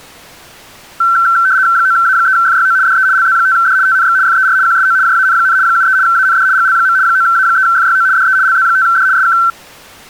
RTTY (75 baud, 170 Hz shift), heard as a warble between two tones, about 1440 Hz centre. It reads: 9A3FYO DE LZ5D TNX FER QSO JAN, 73 AND GL. 9A3FYO DE LZ5D SK